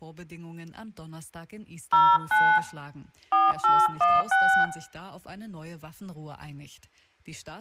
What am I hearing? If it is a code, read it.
DTMF, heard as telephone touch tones, dialled by hand, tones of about 270 ms, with room echo. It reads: 09 4816